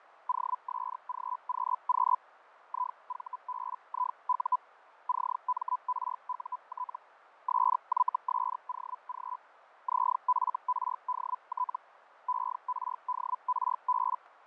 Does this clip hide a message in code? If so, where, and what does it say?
Yes: Hellschreiber (Feld-Hell, 122.5 baud) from 0.3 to 14.2 s, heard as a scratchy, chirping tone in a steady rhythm, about 1000 Hz, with radio static and fading. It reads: OSGQQ IVBIU CMRUT SYSOG ZFRDT ERDRB